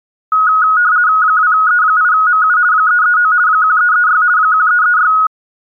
RTTY (50 baud, 170 Hz shift), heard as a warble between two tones, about 1360 Hz centre. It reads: 2E8MU 339 1336 1336